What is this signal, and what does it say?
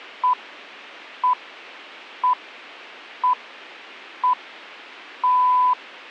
Radio time signal (six pips, as the Greenwich Time Signal), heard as pips.